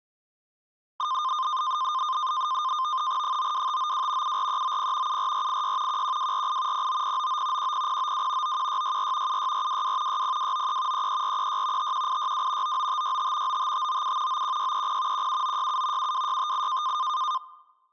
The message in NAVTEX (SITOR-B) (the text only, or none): 92592 74390 74486 11248 09099 10092 91664 76422 60293 33436 51862 99565 95597 91630 17967 72658